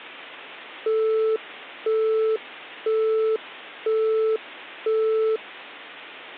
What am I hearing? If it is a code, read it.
Telephone call progress tone (single-tone plan, as in Europe, Japan and elsewhere), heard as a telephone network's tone, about 440 Hz, 0.5 s on and 0.5 s off, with hum. Busy tone.